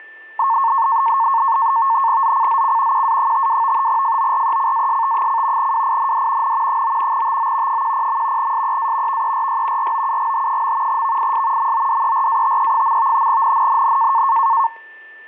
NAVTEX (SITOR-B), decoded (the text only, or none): ZCZC QA52 FORECAST: WIND N 9 TO 10. SEA VERY ROUGH. VIS MODERATE. NNNN